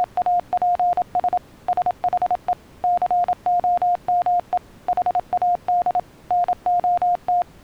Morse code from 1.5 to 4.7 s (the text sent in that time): SHE COME